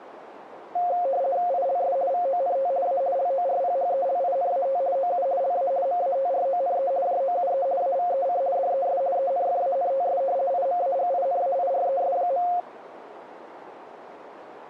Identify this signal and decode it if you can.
RTTY (50 baud, 170 Hz shift), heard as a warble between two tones, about 620 Hz centre, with radio static. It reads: ILS VONT A LORPHELINAT OU LA MATRONE JOUE AVEC DES ENFANTS IMAGINAIRES.